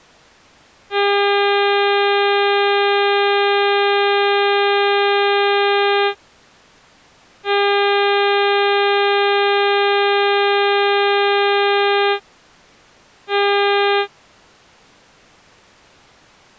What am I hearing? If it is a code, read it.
Ship horn signal, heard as a ship's horn, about 400 Hz. 2 long, 1 short. At sea: I intend to overtake on your starboard side.